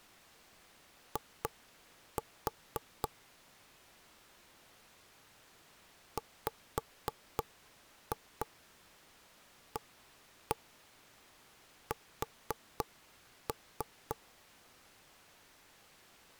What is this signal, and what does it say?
Tap code, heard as knocks on wood, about 3 knocks a second. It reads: I WAS